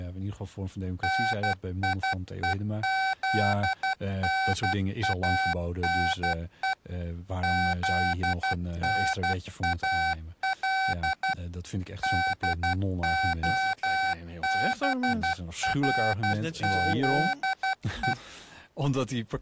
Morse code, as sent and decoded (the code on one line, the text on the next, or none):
-. .. . --.. -. .- -. . / --.. -. .- .-.. / -.. --- -... .-. --.. .
NIEZNANE ZNAL DOBRZE